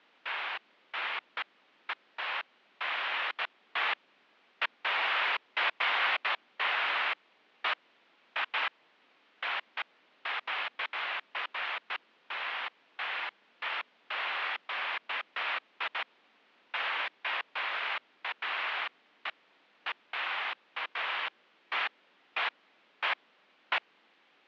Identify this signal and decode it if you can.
Bursts of noise. There is no code.